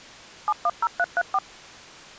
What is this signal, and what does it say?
DTMF, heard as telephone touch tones, dialled by machine, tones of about 50 ms. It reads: 710334